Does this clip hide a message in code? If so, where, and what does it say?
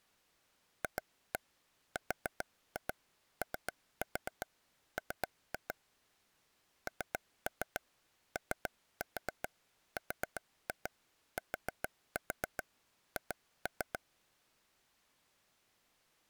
Yes: tap code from 0.8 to 14.0 s, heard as taps on a table, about 7 knocks a second. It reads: FROM NORTH